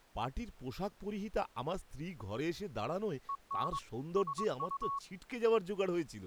Morse code, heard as a keyed tone, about 22 wpm, 1110 Hz, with speech in Bangla. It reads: EN SU